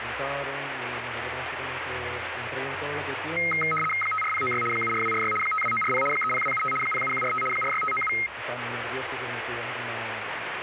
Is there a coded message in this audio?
Yes: RTTY (75 baud, 850 Hz shift) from 3.4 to 8.3 s, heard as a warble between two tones, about 1700 Hz centre, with radio static. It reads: 54096 74246 52940 30275 07145 46597